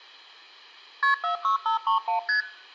Multi-frequency trunk signalling (R1, as on North American trunks), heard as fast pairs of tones, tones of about 120 ms. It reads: KP 46531 ST